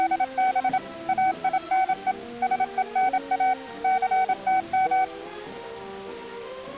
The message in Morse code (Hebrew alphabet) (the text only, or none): … אינו שונא סתם